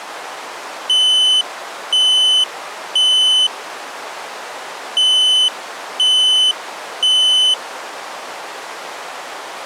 Alarm pattern, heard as an alarm's beeps, played twice, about 3000 Hz. Temporal three. Smoke or fire, evacuate.